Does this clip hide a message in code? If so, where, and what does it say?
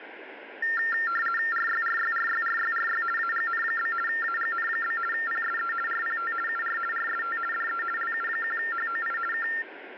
Yes: RTTY (50 baud, 450 Hz shift) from 0.6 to 9.6 s, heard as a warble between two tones, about 1600 Hz centre, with radio static. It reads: RYRYRYRYRY AGN? AGN? PSE RPT UR RST DE LU1HOI K